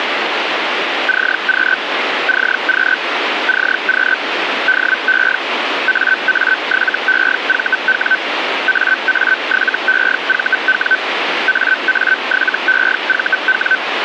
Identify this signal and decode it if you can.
Hellschreiber (Feld-Hell, 122.5 baud), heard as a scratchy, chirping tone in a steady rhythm, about 1550 Hz, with radio static. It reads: CQ CQ CQ DE AA7EVW AA7EVW AA7EVW